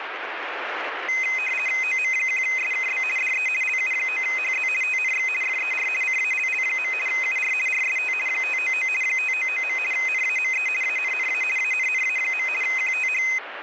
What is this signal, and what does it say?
RTTY (50 baud, 450 Hz shift), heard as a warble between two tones, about 2300 Hz centre, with radio static. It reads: OM1SKB DE LU9HZ TNX FER CALL. UR RST 599 599. NAME ANNA ANNA. QTH